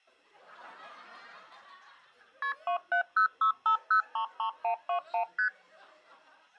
Multi-frequency trunk signalling (R1, as on North American trunks), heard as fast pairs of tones, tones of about 100 ms. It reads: KP 27065033121 ST